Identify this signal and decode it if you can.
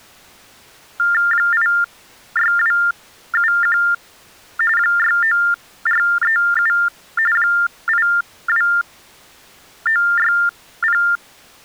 TTY/TDD text telephone tones (45.45 baud Baudot), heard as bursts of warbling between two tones, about 400 Hz shift, 1600 Hz centre. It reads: 86271 69437 82960